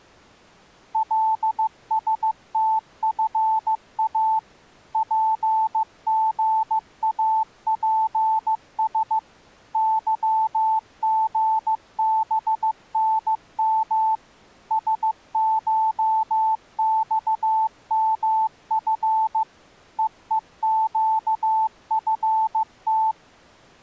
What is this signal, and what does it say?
Morse code (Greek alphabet), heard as a keyed tone, machine-sent, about 15 wpm, 880 Hz. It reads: ΛΣΤΦΑ ΠΓΑΠΣ ΥΓΒΝΜ ΣΧΞΜΦ ΕΕΨΦΤ